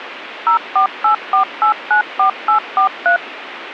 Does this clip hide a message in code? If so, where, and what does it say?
Yes: DTMF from 0.5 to 3.2 s, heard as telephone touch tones, dialled by machine, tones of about 110 ms, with radio hiss. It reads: 0484894843